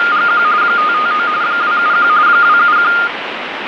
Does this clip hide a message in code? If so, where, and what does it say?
Yes: RTTY (45.45 baud, 170 Hz shift) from 0.0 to 3.1 s, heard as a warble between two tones, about 1320 Hz centre, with radio static. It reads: … 559 271 271